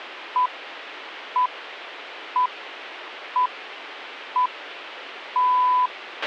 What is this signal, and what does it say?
Radio time signal (six pips, as the Greenwich Time Signal), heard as pips, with a squelch burst at the end.